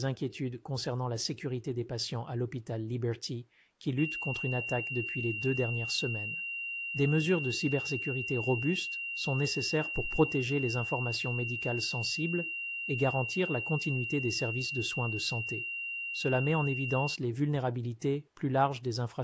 A steady tone, with speech in French. There is no code.